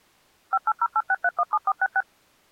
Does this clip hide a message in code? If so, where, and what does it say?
Yes: DTMF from 0.5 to 2.0 s, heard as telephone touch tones, dialled by machine, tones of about 50 ms. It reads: 58086317466